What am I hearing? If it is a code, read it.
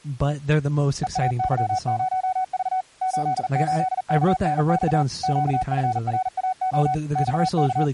Morse code, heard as a keyed tone, machine-sent, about 40 wpm, 750 Hz, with speech in English. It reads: EAY0V 88KNX QFRAO …